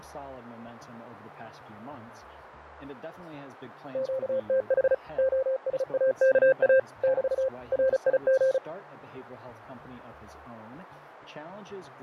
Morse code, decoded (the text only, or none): QTH OSAKA <BT> RIG